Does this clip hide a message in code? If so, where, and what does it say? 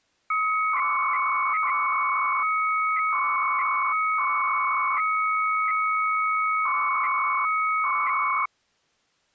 Yes: 300-baud modem data (Bell 103 tones) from 0.3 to 8.5 s, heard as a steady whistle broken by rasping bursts, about 300 baud, 200 Hz shift.